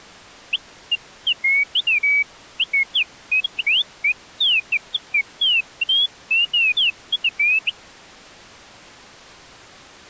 Bird-like chirps. There is no code.